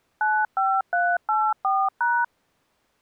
DTMF, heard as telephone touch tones, dialled by machine, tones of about 240 ms. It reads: 95384#